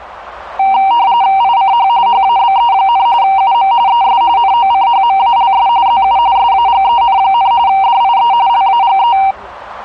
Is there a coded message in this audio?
Yes: RTTY (45.45 baud, 170 Hz shift) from 0.6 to 9.3 s, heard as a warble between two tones, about 860 Hz centre, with the noise of a restaurant. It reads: ICH HABE, UM ES NOCHMALS ZU SAGEN, DIE LAGE